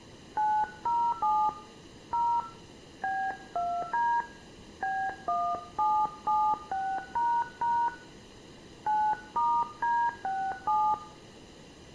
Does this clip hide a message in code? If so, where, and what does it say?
Yes: DTMF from 0.4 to 10.9 s, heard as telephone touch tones, dialled by hand, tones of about 270 ms, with room echo. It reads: 907 0 B2D B1776## 9*D67